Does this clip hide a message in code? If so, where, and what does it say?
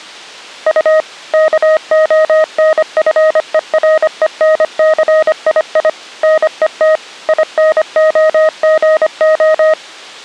Yes: Morse code (Russian alphabet) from 0.6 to 9.8 s, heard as a keyed tone, machine-sent, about 25 wpm, 630 Hz. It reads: У КОНФЕРЕНЦИИ НЕТ ИНОГО